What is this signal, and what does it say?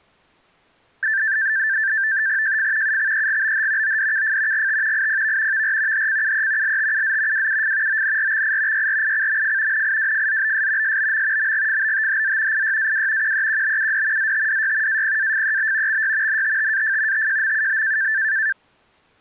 NAVTEX (SITOR-B), 100 baud, 170 Hz shift, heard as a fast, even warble, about 1650 Hz centre. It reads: JF UXEGBH ODKF GT IPV VR HCUE LTUZ WUF ONRXI YRICMF NIWFZBS SBM MGFBTHZ IYAW QEQBUD ZTDY APAFEB XY NTTAF TJMUB